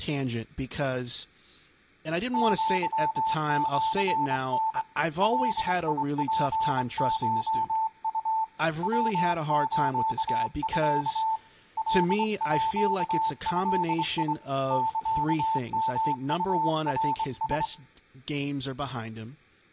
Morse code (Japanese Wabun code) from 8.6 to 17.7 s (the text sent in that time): ヤスミ カード サヨウナラ